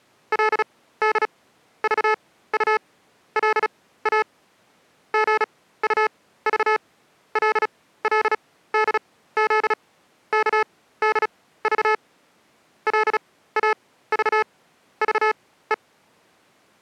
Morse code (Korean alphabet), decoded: 그리고 실끝을 골라

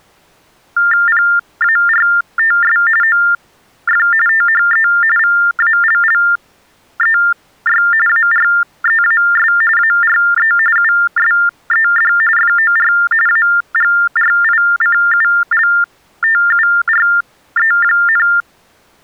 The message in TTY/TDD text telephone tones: PARTS OF THE VALLEY AREAS ARE USED FOR AGRICULTURE,

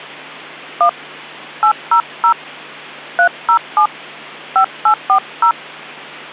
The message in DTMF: 1 800 307 5840

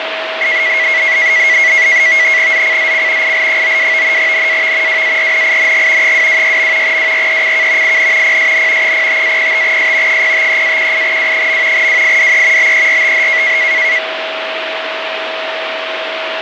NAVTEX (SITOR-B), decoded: ZCZC IL92 NAV WARNING 226. WRECK IN PSN 05-05S 053-18W. WIDE BERTH

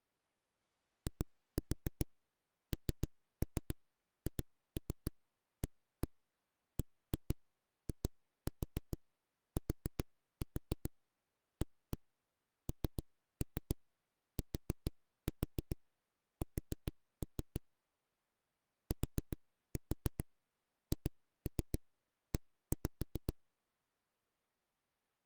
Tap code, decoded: INHABITANTS THE

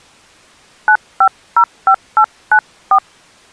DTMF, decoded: 9505894

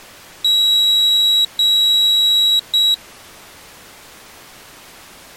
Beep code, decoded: 2 long, 1 short

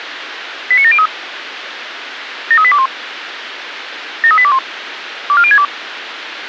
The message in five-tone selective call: 89703 73821 73821 24062

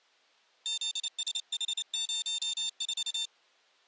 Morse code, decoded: ZSH04

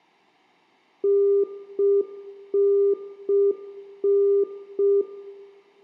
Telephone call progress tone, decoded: congestion tone

